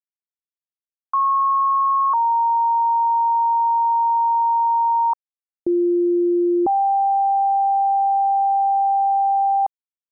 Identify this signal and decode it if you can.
Two-tone page, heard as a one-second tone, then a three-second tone, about 1090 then 930 Hz, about 350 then 790 Hz.